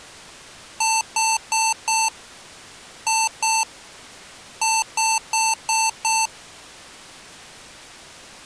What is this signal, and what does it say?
Beep code, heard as beeps from a small speaker, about 890 Hz. 4-2-5.